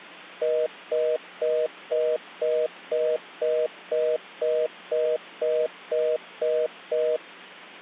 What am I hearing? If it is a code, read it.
Telephone call progress tone (North American plan), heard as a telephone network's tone, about 480, 620 Hz, 0.25 s on and 0.25 s off. Congestion tone.